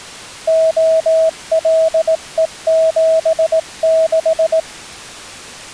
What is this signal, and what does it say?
Morse code, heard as a keyed tone, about 18 wpm, 650 Hz. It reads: OLE76